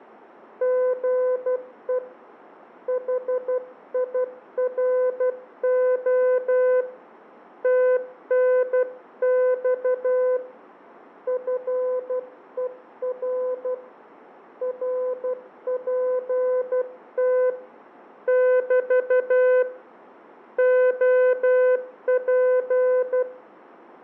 Morse code, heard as a keyed tone, hand-sent with a paddle, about 12 wpm, 510 Hz, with fading and room echo. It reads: GE HIRO TNX FER RPT <BT> OP